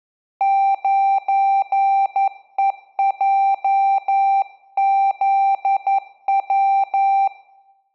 Morse code, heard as a keyed tone, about 11 wpm, 780 Hz, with room echo. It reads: 9EJZW